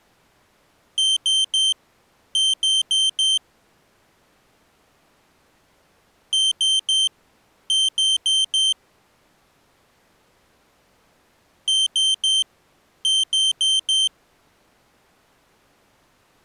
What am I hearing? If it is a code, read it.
Beep code, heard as a piezo beeper, played three times, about 3100 Hz. 3-4.